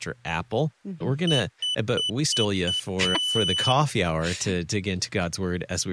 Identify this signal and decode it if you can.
Beep code, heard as a piezo beeper, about 3000 Hz, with speech in English. 5 short, 1 long.